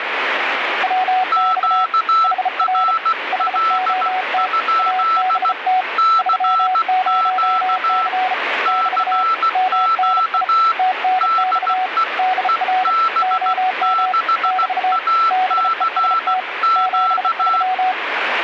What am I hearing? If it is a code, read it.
Morse code, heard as two keyed tones, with radio static. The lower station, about 34 wpm, 740 Hz: WX HR HOT ABT 30C <BT> MNI TNX DR OM <BT> BEST 73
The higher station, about 16 wpm, 1330 Hz: QRL? CQ CQ DE EB6ACQ